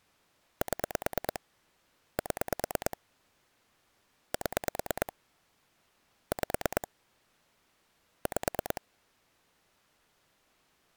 Pulse dialling, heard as clicks on a phone line, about 9 pulses a second. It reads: 7 7 7 5 5